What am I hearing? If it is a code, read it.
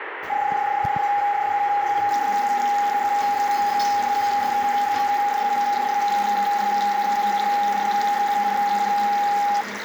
PSK31 (31.25 baud), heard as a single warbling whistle, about 820 Hz, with radio static and the noise of a restroom.